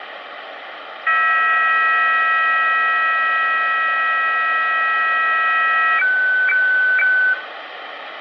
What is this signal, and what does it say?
Weather fax (radiofax), 120 lines a minute, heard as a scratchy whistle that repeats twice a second, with radio static and room echo.